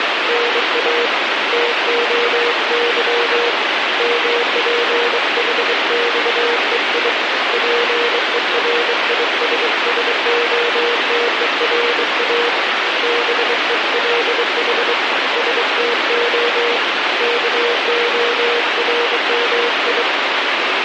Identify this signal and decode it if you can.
Morse code (Greek alphabet), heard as a keyed tone, hand-sent with a bug key, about 23 wpm, 480 Hz, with heavy radio static. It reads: ΝΑ ΤΟΥ ΜΠΗΞΕΙ ΠΕΡΙΣΣΟΤΕΡΑ ΒΕΛΗ ΣΤΟ ΚΟΡΜΙ